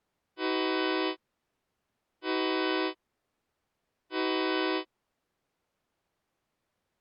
Train horn signal, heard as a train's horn. 3 short. On North American railways: when stopped, the train will back up.